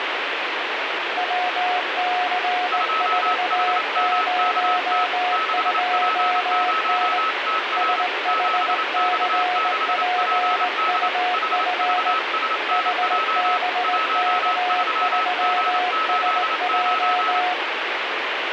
Morse code, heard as two keyed tones, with heavy radio static. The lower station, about 19 wpm, 720 Hz: WC402N SHCPUF HBK3SJ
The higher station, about 28 wpm, 1290 Hz: 2HMKT 6P0TR 7X6PD HVSNJ 13G89